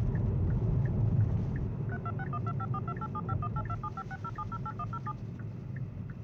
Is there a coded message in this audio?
Yes: DTMF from 1.9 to 5.1 s, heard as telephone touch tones, dialled by machine, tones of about 50 ms, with the noise inside a car. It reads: 326125428751827560708107